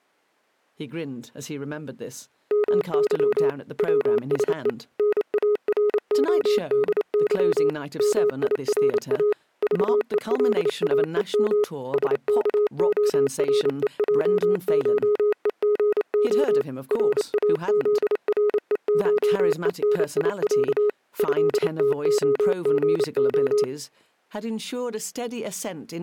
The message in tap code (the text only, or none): none